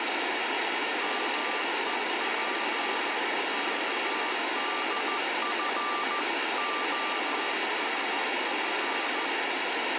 Morse code (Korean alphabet), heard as a keyed tone, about 14 wpm, 1180 Hz, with heavy radio static and fading. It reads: 맞은편